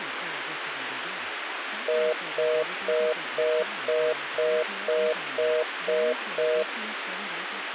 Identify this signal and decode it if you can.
Telephone call progress tone (North American plan), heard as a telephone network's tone, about 480, 620 Hz, 0.25 s on and 0.25 s off, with phone line noise and speech in English. Congestion tone.